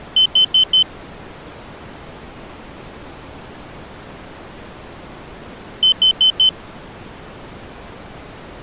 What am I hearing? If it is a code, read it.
Alarm pattern, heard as an alarm's beeps, played twice, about 3050 Hz. Temporal four. Carbon monoxide.